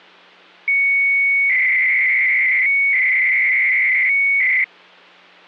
300-baud modem data (Bell 103 tones), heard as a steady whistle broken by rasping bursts, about 300 baud, 200 Hz shift.